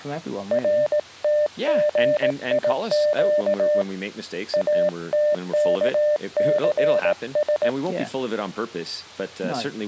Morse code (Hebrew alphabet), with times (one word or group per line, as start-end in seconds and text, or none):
0.5-3.8 רתגיק
4.5-7.7 אתכסש